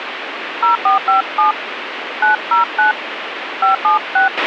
DTMF, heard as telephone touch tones, dialled by hand, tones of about 130 ms, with radio hiss and a squelch burst at the end. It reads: 0457 909 576